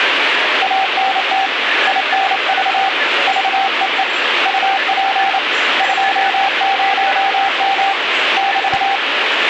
Morse code, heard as a keyed tone, hand-sent with a paddle, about 28 wpm, 780 Hz, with radio static and the noise of a crowd indoors. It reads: ANT INV VEE UP 20M <BT>